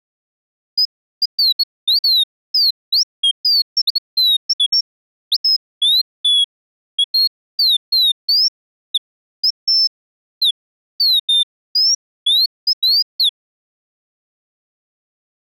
Bird-like chirps. There is no code.